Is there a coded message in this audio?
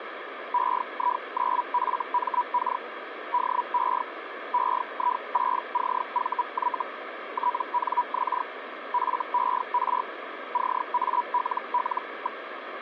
Yes: Hellschreiber (Feld-Hell, 122.5 baud) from 0.5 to 12.4 s, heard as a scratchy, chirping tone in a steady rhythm, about 980 Hz, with radio static. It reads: EI9FMK DE EI6CVY TNX FER CALL.